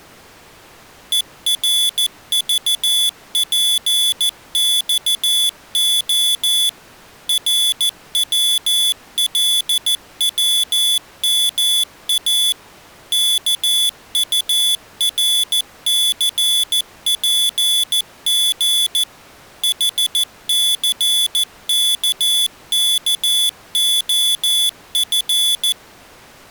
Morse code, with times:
1.1-6.7 ERVPXO
7.3-12.5 RWLWMA
13.1-19.0 KURCPG
19.6-25.7 HCKKOF

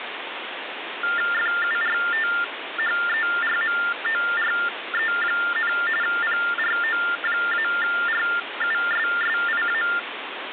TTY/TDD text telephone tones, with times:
1.3-5.7 FURTHERMORE,
6.0-9.8 PRO-RUSSIA

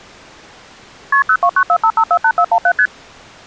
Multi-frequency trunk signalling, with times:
1.1-1.2 KP
1.3-2.7 02945548417
2.8-2.9 ST

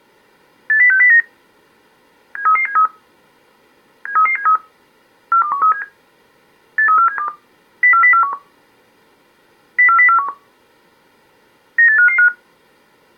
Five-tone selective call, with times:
0.7-1.2 80609
2.4-2.9 73373
4.1-4.6 73373
5.3-5.8 42137
6.8-7.3 83472
7.8-8.3 04041
9.8-10.3 04041
11.8-12.3 98555

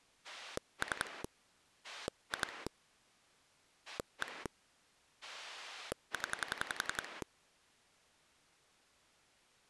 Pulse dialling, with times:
0.2-1.2 3
1.8-2.7 2
3.9-4.5 1
5.2-7.2 0

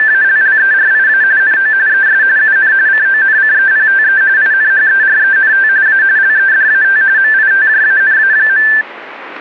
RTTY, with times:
0.0-1.2 …
1.4-1.7 NO
1.9-2.2 ES
2.4-2.7 UN
2.9-4.2 CONCEPTE
4.4-5.7 INHERENT
5.9-6.0 A
6.2-7.0 LEDAT
7.2-8.7 MITJANA.

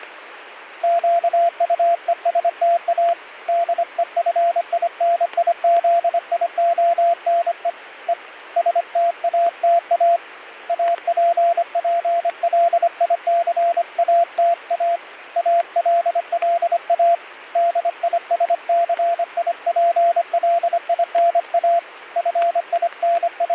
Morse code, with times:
0.8-3.1 QUESTA
3.5-7.7 DEFINIZIONE
8.1-8.1 E
8.6-10.2 STATA
10.7-15.0 APPLICATA
15.4-17.1 ALLA
17.6-21.8 DISCIPLINA
22.2-23.5 …

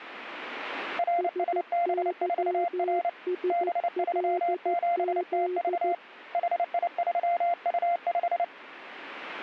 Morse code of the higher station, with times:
1.0-3.1 RSB4R
3.5-5.9 B37TV
6.3-8.4 HI3U5

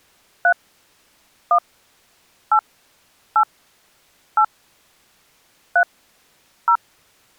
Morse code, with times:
none

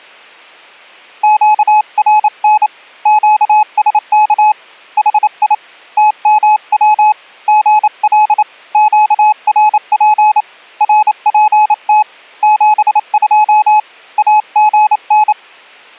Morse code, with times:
1.2-2.7 QRN
3.1-4.5 QSK
5.0-5.5 HI
6.0-7.1 TMW
7.5-8.4 GL
8.7-10.4 QRP
10.8-12.0 RPT
12.4-13.8 72
14.2-15.3 AGN

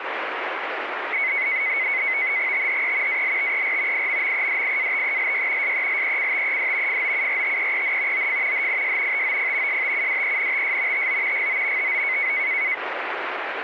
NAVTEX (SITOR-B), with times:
2.5-3.2 THE
3.1-4.1 ALTER
3.9-5.7 IMMEDIATELY
5.6-7.0 SELECTED
6.9-8.3 FOURTEEN
8.1-8.7 OF
8.5-9.2 HIS
9.1-9.8 TOP
9.7-11.1 STUDENTS
10.9-11.5 TO
11.3-11.9 GO
11.8-12.3 TO

